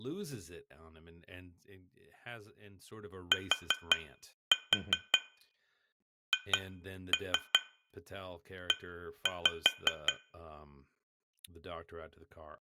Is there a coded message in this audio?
Yes: tap code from 3.3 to 10.2 s, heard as taps on glass, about 5 knocks a second, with room echo and speech in English. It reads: THE